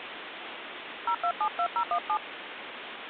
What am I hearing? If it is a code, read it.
DTMF, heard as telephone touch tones, dialled by hand, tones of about 80 ms, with phone line noise. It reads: 0272017